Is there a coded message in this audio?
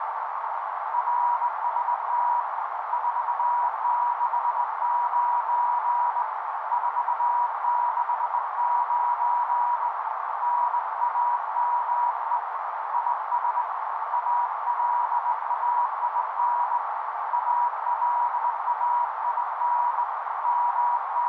Yes: Morse code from 0.9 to 21.3 s, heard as a keyed tone, hand-sent with a straight key, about 20 wpm, 960 Hz, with heavy radio static and a narrow filter. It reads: RST 469 469 NAME IS ALAIN ALAIN …